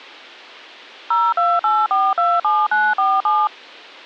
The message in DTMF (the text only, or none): 028427947